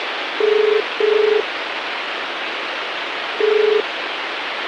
Telephone call progress tone (as in the UK, Ireland, Australia and similar networks), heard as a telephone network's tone, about 430 Hz, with phone line noise. Ringback tone.